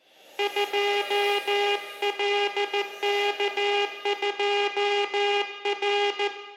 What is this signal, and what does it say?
Morse code, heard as a buzzer, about 14 wpm, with room echo. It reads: 2LK2R